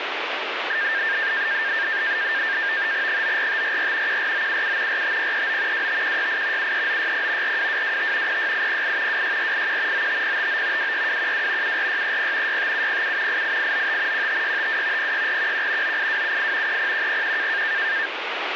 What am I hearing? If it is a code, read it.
NAVTEX (SITOR-B), 100 baud, 170 Hz shift, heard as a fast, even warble, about 1700 Hz centre, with radio static. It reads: 94544 14977 45039 25168 73960 42225 06808 26481 95059 26212 74630 65707 88895 15652 06411 98278 30101